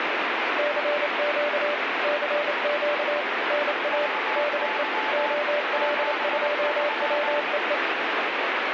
Morse code, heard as two keyed tones, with heavy radio static. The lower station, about 28 wpm, 590 Hz: CQ CQ NA DE OL2WEE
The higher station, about 21 wpm, 870 Hz: VY 73